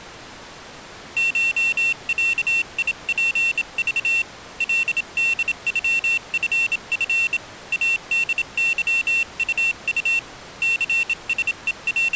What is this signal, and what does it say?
Morse code (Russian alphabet), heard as a high beeper, hand-sent with a bug key, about 27 wpm, 2700 Hz. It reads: ШЯИПЖ ЛДЮФФ АДЫУУ …